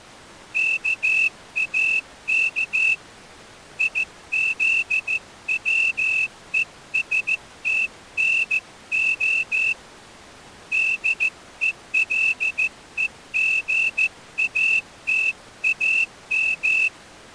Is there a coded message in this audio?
Yes: Morse code (Russian alphabet) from 0.5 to 16.9 s, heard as a whistle, hand-sent with a straight key, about 14 wpm. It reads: КАК ИЗВЕСТНО ДЕЛЕГАТАМ